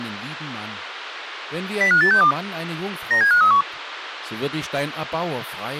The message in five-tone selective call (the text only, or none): 05862 97531